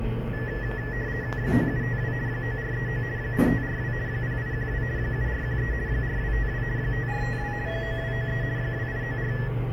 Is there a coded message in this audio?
Yes: RTTY (50 baud, 170 Hz shift) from 0.3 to 9.5 s, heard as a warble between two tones, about 1800 Hz centre, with the noise inside a lift. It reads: 9752 9439 8542 0812 7413 4252 5452 9293 2894